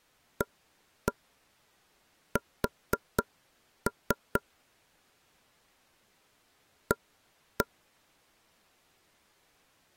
Tap code, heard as taps on a table, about 4 knocks a second. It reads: AS A